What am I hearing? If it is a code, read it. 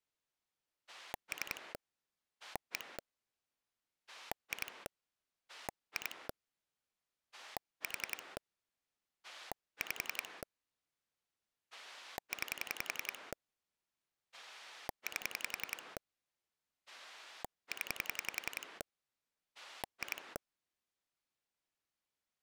Pulse dialling, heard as a rotary dial, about 10 pulses a second. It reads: 3 1 2 2 4 5 9 8 0 2